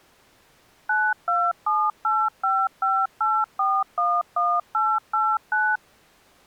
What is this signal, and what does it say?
DTMF, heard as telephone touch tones, dialled by machine, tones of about 240 ms. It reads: 9278558411889